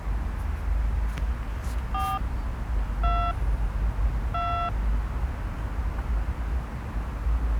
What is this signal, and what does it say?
DTMF, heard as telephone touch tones, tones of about 290 ms, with the noise of a residential street. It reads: 4 2 2